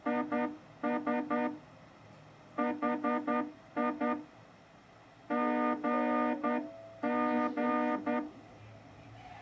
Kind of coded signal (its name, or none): Morse code